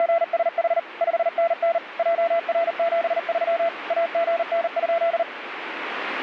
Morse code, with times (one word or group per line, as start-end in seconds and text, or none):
0.0-0.8 …
1.0-1.8 5NN
2.0-3.7 JR73
3.9-5.2 AGN?